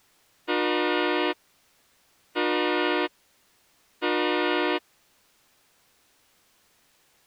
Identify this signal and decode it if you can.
Train horn signal, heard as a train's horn. 3 short. On North American railways: when stopped, the train will back up.